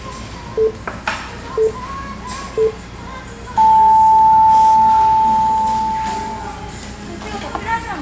Radio time signal (three low pips and a long one an octave up, as on NHK), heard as pips, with the noise of a restaurant.